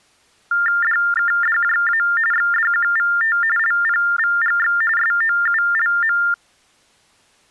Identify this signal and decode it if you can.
TTY/TDD text telephone tones (45.45 baud Baudot), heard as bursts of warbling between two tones, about 400 Hz shift, 1600 Hz centre. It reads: DKDJA XDQVT LPVGX SOULM